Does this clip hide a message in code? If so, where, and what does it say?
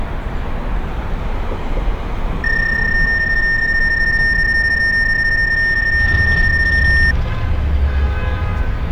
Yes: PSK31 (31.25 baud) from 2.4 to 7.1 s, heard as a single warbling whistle, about 1800 Hz, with street noise.